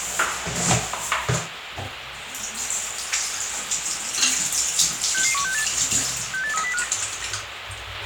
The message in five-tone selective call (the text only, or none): 66168 68305